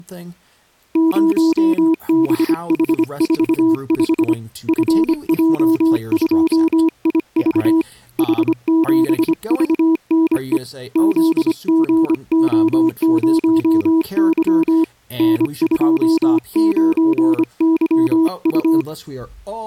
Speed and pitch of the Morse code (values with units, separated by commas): 25 wpm, 320 Hz